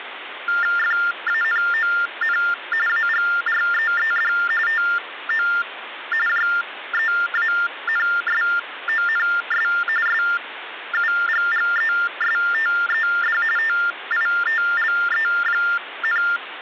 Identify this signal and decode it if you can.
TTY/TDD text telephone tones (45.45 baud Baudot), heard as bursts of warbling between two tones, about 400 Hz shift, 1600 Hz centre, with phone line noise. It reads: FANON AGREED TO JEANSONS SUGGESTED TITLE,